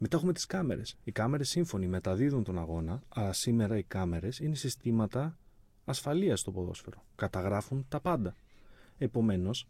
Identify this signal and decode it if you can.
Speech in Greek. There is no code.